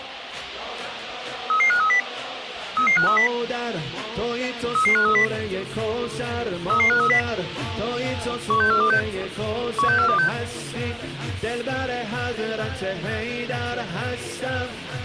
Five-tone selective call (CCIR), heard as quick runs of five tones, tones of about 100 ms. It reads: 33530 33530 33530 33530 16426 16426